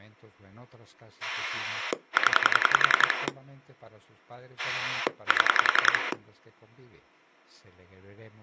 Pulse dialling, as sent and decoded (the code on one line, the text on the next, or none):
10 / 7
0 7